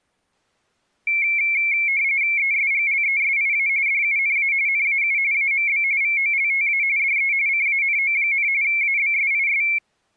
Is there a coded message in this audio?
Yes: RTTY (45.45 baud, 170 Hz shift) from 1.1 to 9.8 s, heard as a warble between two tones, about 2250 Hz centre. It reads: ESGLESIA DUNA NAU AMB VOLTA DE CANO, ABSIS